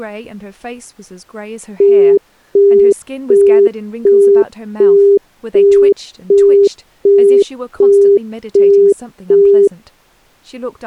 Telephone call progress tone (as in the UK, Australia and similar networks), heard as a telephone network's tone, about 400 Hz, 0.375 s on and 0.375 s off, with speech in English. Busy tone.